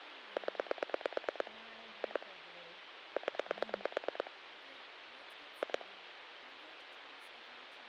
Pulse dialling, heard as clicks on a phone line, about 9 pulses a second, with phone line noise and speech in English. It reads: 0 2 0 2